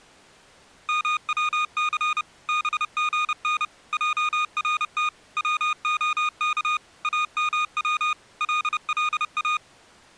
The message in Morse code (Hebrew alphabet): מצס בגן ערת צהך אמץ ללא

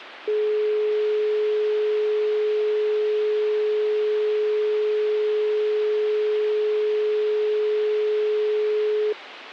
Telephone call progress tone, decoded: dial tone

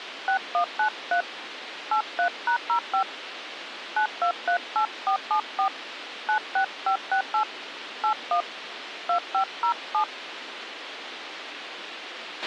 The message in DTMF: 6193 83#05 9238474 96568 81 2507

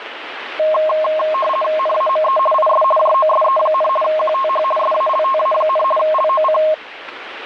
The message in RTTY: NAME IS JOSE, QTH SALTA, LOC

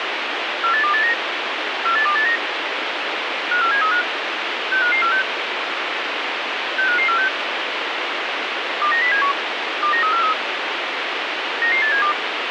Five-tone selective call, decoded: 48289 48289 54735 65546 65546 29071 29343 99872

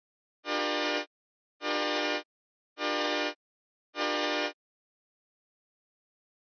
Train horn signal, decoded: 4 short

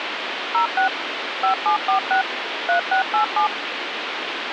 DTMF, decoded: 06 5746 3687

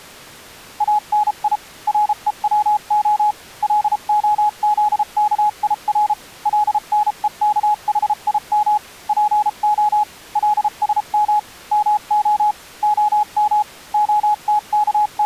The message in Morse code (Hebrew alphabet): אני רוצה להזכיר לנוכחים פה לשם מה הם …

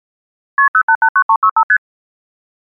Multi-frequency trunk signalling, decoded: KP 0889365 ST

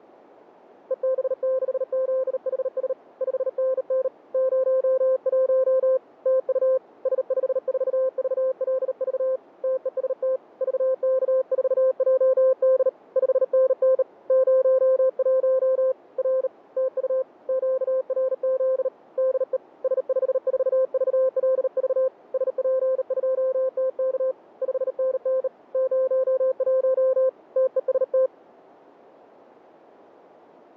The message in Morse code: EB6ZHS 5NN 01 TU S54VLV TEST VK4JD 5NN 01 R TU QRZ DE S54VLV SP2TK 5NN 01 TEST

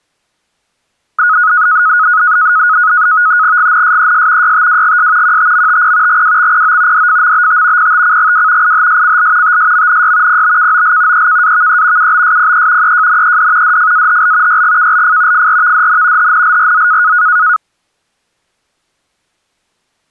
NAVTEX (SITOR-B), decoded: GNSES YTWGS QTMTP GWXPO DFMBT PTCGW IHSCL TSMNY PBKOL EKAVE UBSPE EJNED DFAHL YGKLF FRVDN HNLRZ

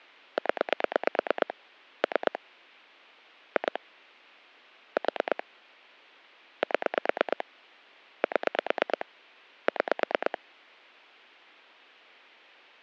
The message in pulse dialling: 0 3 2 4 7 7 6

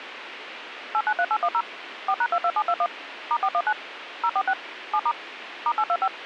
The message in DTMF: 893810 4#22721 *419 046 7* *825

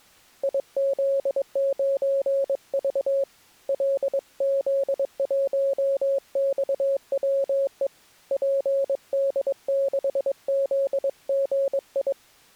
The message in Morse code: IZ9V LZ1XWE PD6ZGI

